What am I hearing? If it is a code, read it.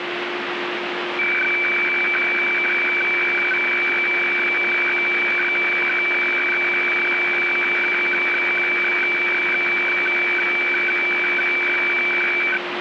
Weather fax (radiofax), 120 lines a minute, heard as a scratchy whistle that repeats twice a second, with radio static and a steady whistle near 350 Hz.